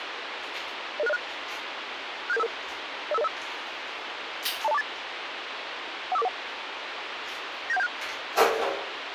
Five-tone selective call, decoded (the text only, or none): 00606 67755 05505 20248 15441 97176